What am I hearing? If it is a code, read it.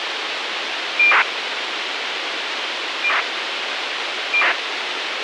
ACARS aircraft data, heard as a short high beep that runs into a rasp, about 2400 baud, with radio hiss.